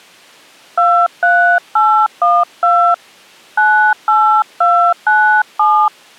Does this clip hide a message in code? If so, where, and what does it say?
Yes: DTMF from 0.8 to 5.9 s, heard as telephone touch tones, dialled by hand, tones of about 290 ms. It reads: 23812 98297